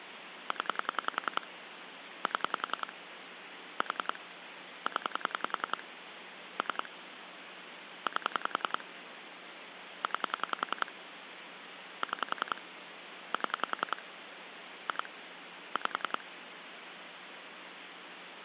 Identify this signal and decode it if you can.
Pulse dialling, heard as clicks on a phone line, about 10 pulses a second, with phone line noise. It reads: 0 7 4 0 3 8 9 6 7 2 5